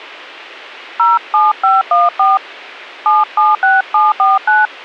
DTMF, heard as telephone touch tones, dialled by hand, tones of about 180 ms. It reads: 07514 776749